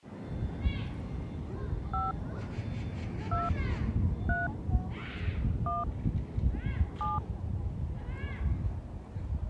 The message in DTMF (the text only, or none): 5 2 3 1 7